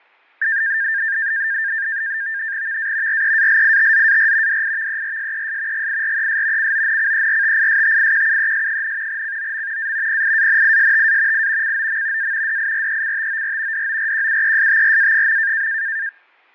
NAVTEX (SITOR-B), 100 baud, 170 Hz shift, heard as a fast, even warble, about 1700 Hz centre, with fading. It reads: VA REALITZAR DIVERSES GIRES CONCERTISTIQUES, COM A PIANISTA I COM A DIRECTOR DORQUESTRA.